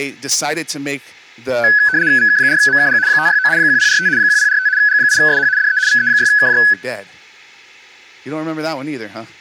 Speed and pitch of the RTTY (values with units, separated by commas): 75 baud, 170 Hz shift, 1600 Hz centre